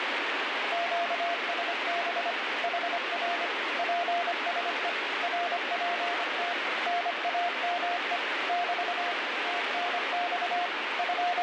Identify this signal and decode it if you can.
Morse code, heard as a keyed tone, machine-sent, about 25 wpm, 700 Hz, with heavy radio static. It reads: QSB HR PSE RPT NAME <BT> TNX …